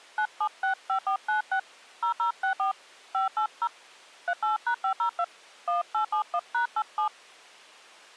DTMF, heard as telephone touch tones, dialled by hand, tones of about 100 ms. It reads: 9765496 0064 580 38#502 1871#87